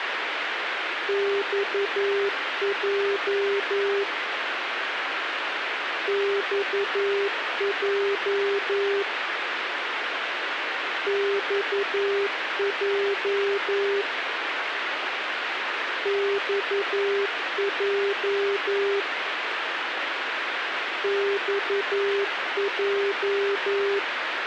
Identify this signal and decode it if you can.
Morse code, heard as a keyed tone, machine-sent, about 11 wpm, 400 Hz, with radio hiss and a squelch burst at the end. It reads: XJ XJ XJ XJ XJ